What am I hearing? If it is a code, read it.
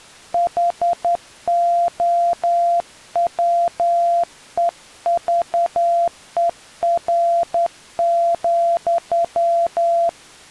Morse code, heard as a keyed tone, hand-sent with a straight key, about 10 wpm, 690 Hz. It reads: HOWEVER,